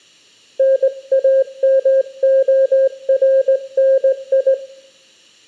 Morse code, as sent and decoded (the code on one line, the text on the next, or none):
-. .- -- --- .-. -. ..
NAMORNI